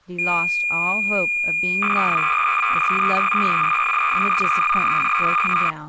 Cassette data (Kansas City type), 300 baud, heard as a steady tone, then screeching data, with speech in English.